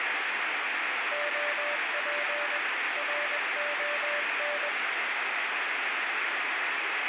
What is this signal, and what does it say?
Morse code, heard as a keyed tone, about 21 wpm, 590 Hz, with heavy radio static. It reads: OP RON